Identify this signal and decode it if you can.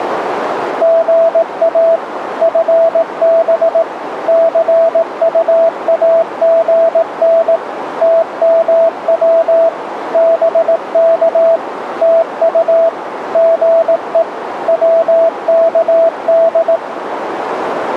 Morse code, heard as a keyed tone, machine-sent, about 18 wpm, 660 Hz, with radio static and a narrow filter. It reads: GA FB CUAGN TMW BK TU GE WKD